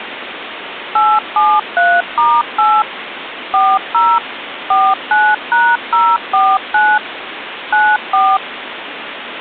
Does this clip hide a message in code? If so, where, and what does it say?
Yes: DTMF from 1.0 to 8.4 s, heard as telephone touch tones, dialled by machine, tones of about 240 ms, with phone line noise. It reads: 873*8 40 49#049 94